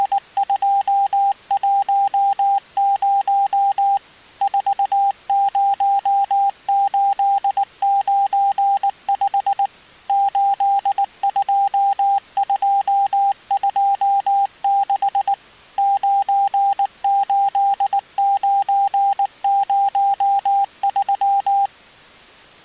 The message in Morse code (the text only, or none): … 40895 82226 98903